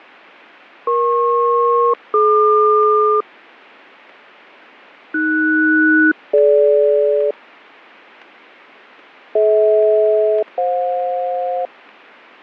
Aircraft SELCAL, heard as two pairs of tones, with fading. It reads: EP-DQ AS-DG DH-FJ